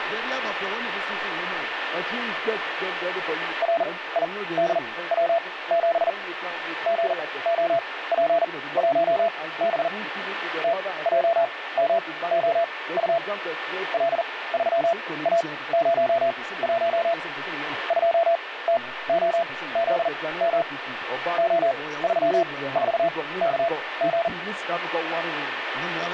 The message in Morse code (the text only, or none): RIDW7 GOP1B TJMOU L3A01 2TOZM O34KG